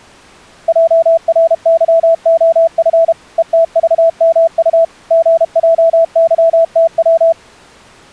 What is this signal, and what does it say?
Morse code, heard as a keyed tone, machine-sent, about 32 wpm, 660 Hz. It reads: JRYOF ETVMU GJYTW